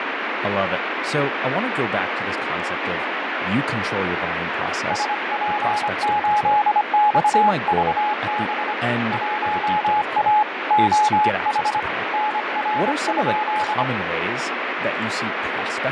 Morse code, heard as a keyed tone, hand-sent with a paddle, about 25 wpm, 840 Hz, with heavy radio static and speech in English. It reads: SP8XVB 1A OH NR?